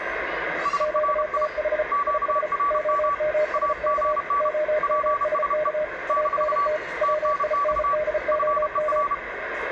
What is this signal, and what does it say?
Morse code, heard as two keyed tones, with radio static, room echo and the noise of a residential street. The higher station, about 31 wpm, 1150 Hz: SRI QRM AGN PSE - TNX FER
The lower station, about 34 wpm, 610 Hz: QTH IS OMSK OMSK ANT WINDOM